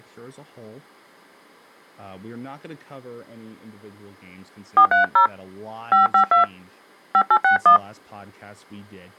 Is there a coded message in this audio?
Yes: DTMF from 4.8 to 7.8 s, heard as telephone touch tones, dialled by hand, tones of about 110 ms, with speech in English. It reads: 430 552 5861